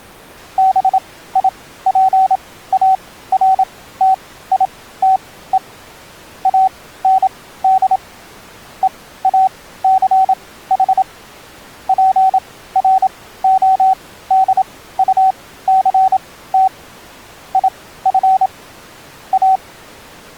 Morse code, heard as a keyed tone, machine-sent, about 27 wpm, spaced as for 16 wpm, 760 Hz. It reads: BIPARTITE AND EACH PRODUCT IF A